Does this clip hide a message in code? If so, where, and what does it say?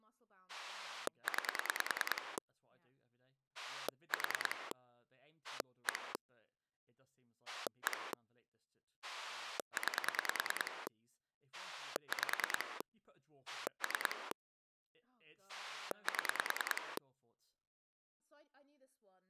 Yes: pulse dialling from 0.5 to 17.0 s, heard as a rotary dial, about 10 pulses a second, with speech in English. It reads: 9 4 1 1 9 5 3 7